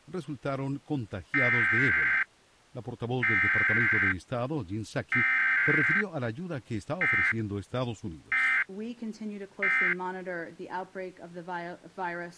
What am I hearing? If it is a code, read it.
Emergency Alert System (SAME) tones (header bursts, then end-of-message bursts), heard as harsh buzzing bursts, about 520.83 baud.